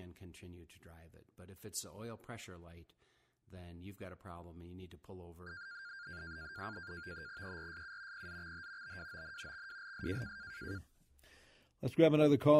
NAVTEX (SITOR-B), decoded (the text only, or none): ERSU PZXH BWON XWLS